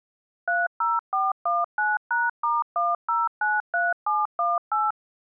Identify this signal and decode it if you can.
DTMF, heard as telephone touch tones, dialled by machine, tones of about 190 ms. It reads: 30419#*1093718